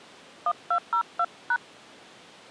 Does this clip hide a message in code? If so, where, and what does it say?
Yes: DTMF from 0.5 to 1.6 s, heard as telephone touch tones, dialled by hand, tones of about 80 ms. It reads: 1202#